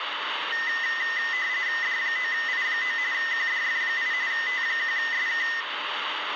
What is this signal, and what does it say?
RTTY (45.45 baud, 170 Hz shift), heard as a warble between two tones, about 1900 Hz centre, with radio static and room echo. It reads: D9I9 QDF8 T1SK